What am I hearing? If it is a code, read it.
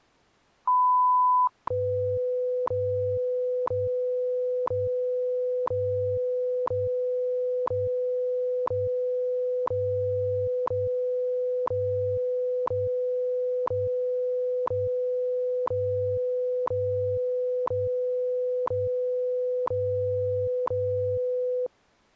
Radio time signal (WWV, Colorado), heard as ticks, one a second.